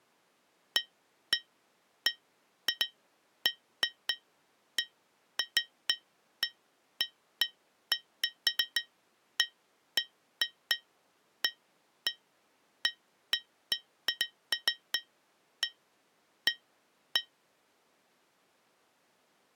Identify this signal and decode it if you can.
Irregular taps on glass. There is no code.